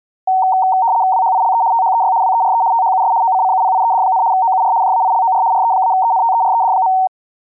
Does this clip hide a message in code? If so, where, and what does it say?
Yes: RTTY (75 baud, 170 Hz shift) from 0.3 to 7.1 s, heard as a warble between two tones, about 840 Hz centre. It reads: WHILE THEY WERE THUS OCCUPIED, OUR JAILOR RE-ENTERED.